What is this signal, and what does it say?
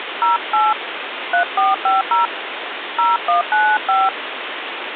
DTMF, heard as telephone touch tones, dialled by hand, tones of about 180 ms, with phone line noise. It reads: 08 3450 0195